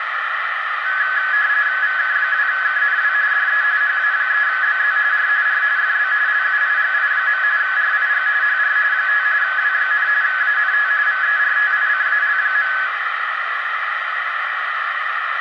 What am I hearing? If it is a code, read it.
RTTY (45.45 baud, 170 Hz shift), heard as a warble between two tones, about 1600 Hz centre, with radio static and a narrow filter. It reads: VK2KNW DE HA3BZ R R FB LUIGI. RIG HR 5 W, ANT VERTICAL.